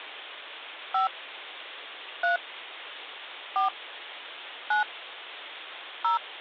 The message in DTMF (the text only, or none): 5 3 4 9 0